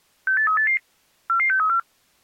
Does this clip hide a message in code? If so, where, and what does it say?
Yes: five-tone selective call (CCIR) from 0.3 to 1.8 s, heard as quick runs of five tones, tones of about 100 ms. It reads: 68388 44634